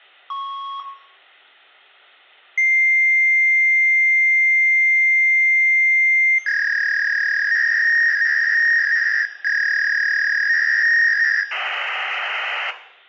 Fax machine handshake, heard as a beep, a long tone, a warble and hiss, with room echo.